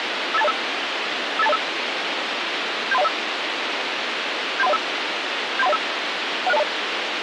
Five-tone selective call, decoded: 58205 58205 73105 73105 73105 16020

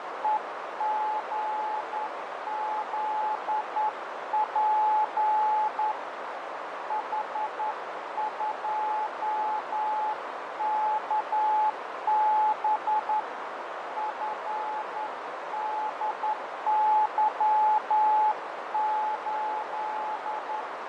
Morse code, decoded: EGZP H2KB FDY8

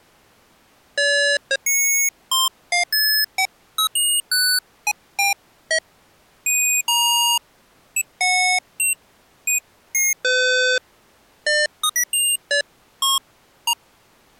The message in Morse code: none

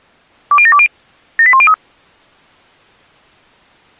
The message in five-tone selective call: 20720 78103

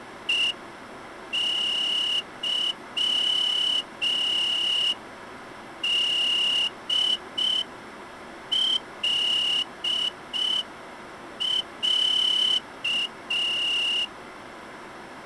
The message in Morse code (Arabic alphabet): ءظدلع

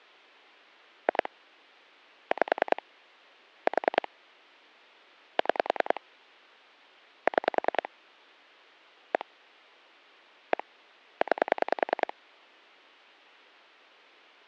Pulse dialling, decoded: 2 5 4 6 6 1 1 9

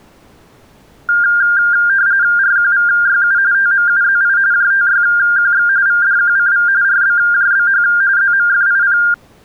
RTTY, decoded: RQVYU TMUZI JTYQX VDQCV RBJBH ZMFIP

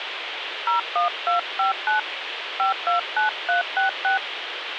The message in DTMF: 01259 529366

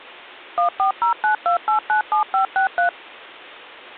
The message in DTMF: 14092897563

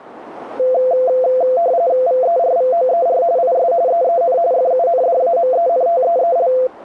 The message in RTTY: VERVOER IS EEN FUNDAMENTEEL

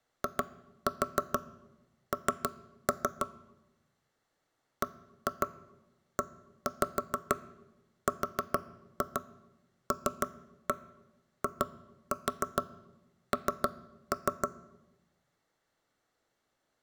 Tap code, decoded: IN BERLIN

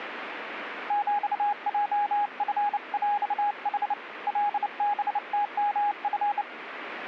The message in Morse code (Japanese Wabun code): ヒヲチヰヌ カハムヨチ

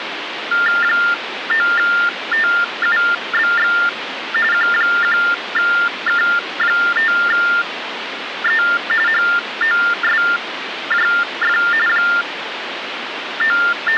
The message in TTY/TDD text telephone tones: 9TUBX Q1K5E HOSJF …

